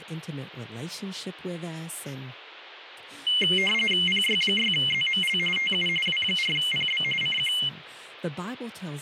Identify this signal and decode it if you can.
RTTY (45.45 baud, 850 Hz shift), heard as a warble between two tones, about 2550 Hz centre, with radio static and speech in English. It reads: PY6ZML TU W4PB CQ